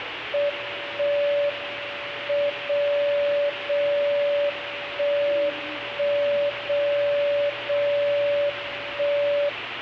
Radio time signal (WWVB), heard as a tone whose level steps once a second, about 580 Hz, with radio static and the noise inside a subway train. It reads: 1 M 0 0 1 1 0 0 1